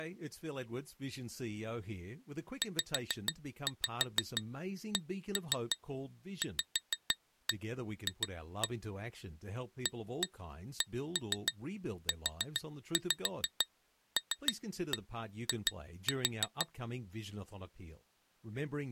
Tap code, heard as taps on glass, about 6 knocks a second, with speech in English. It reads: ZCVF ACULI